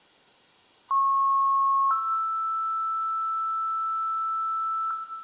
Two-tone page, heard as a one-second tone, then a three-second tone, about 1090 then 1320 Hz, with room echo.